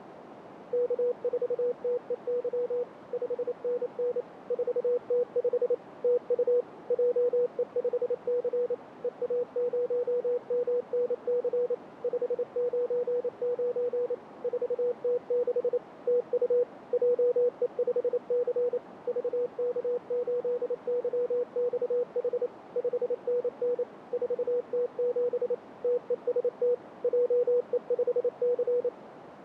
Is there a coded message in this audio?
Yes: Morse code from 0.7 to 28.9 s, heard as a keyed tone, machine-sent, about 28 wpm, 490 Hz, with radio static and a narrow filter. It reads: K4TEY 5NN 4T5 TU JE5C EA0MNC 599 4T6 TU JE5C VK8YXH 5NN 4T7 TEST JE5C